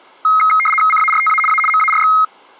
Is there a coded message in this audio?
Yes: RTTY (75 baud, 850 Hz shift) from 0.2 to 2.2 s, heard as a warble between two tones, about 1700 Hz centre. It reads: CARTA A MARX